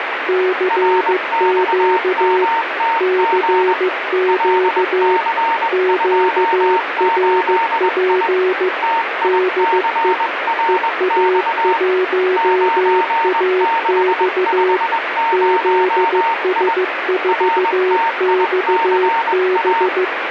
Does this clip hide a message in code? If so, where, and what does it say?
Yes: Morse code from 0.2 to 20.1 s, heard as two keyed tones, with radio static. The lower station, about 15 wpm, 370 Hz: CQ CQ QRP DE EA1AX ZS4XB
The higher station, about 21 wpm, 920 Hz: RXMTG LC28I TICRX 9650I RTICA